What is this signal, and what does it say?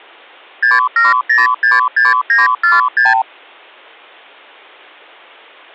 Multi-frequency trunk signalling (R2, with the far end's replies), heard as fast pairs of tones, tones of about 170 ms. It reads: 67066946